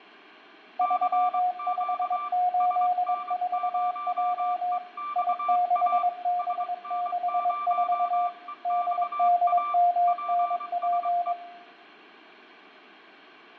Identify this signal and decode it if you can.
Morse code, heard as two keyed tones, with fading and room echo. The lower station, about 22 wpm, 710 Hz: 3584J I6B64 DDMNP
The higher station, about 23 wpm, 1180 Hz: CQ SN0EXA SN0EXA PSE